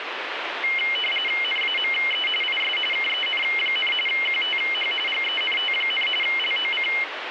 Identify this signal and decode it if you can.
RTTY (45.45 baud, 850 Hz shift), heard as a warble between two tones, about 2550 Hz centre, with radio static. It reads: NAME IS KEN, QTH GENT, LOC